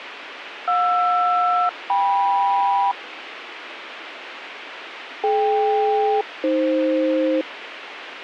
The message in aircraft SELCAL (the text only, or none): JR-KM DK-AF